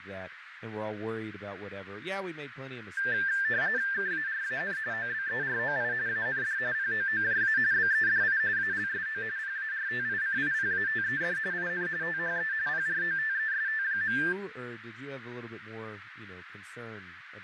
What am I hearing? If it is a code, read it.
RTTY (45.45 baud, 170 Hz shift), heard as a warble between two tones, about 1700 Hz centre, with radio static, fading, a narrow filter and speech in English. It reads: KARAN OBEROI AND POOJA BEDI ALSO PARTICIPATED IN THE PROTEST.